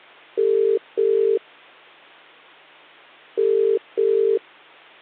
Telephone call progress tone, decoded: ringback tone

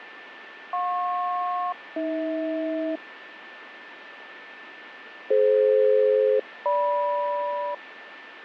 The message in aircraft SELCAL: JP-AH DF-GM

